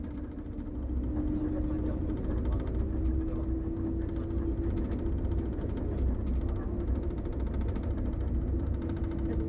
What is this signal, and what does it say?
The noise inside a bus. There is no code.